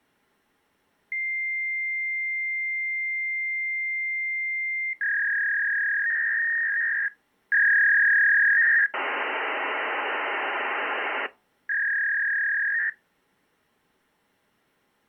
Fax machine handshake, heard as a long tone, a warble and hiss.